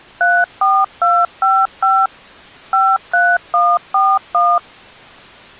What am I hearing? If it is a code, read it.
DTMF, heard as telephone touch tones, dialled by machine, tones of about 230 ms. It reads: 34255 53141